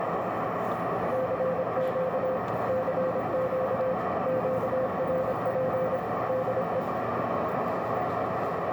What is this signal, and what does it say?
Morse code, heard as a keyed tone, machine-sent, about 26 wpm, 520 Hz, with heavy radio static, a narrow filter and the noise inside a subway train. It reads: CQ CQ QRP DE